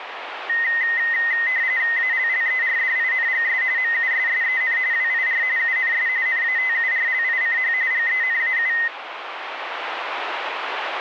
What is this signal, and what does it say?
RTTY (45.45 baud, 170 Hz shift), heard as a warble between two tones, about 1950 Hz centre, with radio static. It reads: ALLERDINGS MUSSEN WIR UNS NATURLICH GENAU